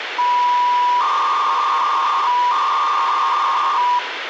300-baud modem data (V.21 tones), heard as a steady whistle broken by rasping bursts, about 300 baud, 200 Hz shift, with phone line noise.